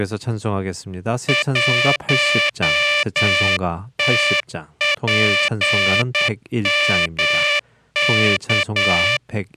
Morse code, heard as a buzzer, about 9 wpm, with speech in Korean. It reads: 1TPMK